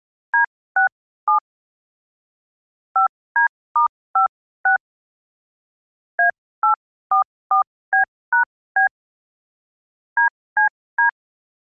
DTMF, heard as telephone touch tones, dialled by hand, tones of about 110 ms. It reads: D67 5D*56 A844B#B DCD